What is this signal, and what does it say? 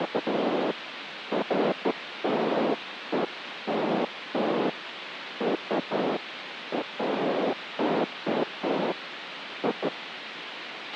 Bursts of noise, with radio hiss and a squelch burst at the end. There is no code.